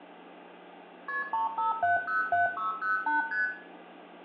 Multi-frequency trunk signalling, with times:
1.1-1.2 KP
1.3-3.2 35707608
3.3-3.5 ST

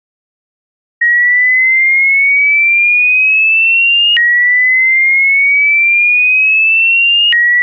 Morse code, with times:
none

